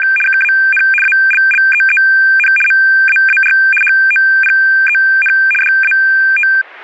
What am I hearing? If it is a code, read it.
RTTY (75 baud, 850 Hz shift), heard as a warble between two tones, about 2000 Hz centre. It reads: … KAN ALLEEN MAAR HOPEN DAT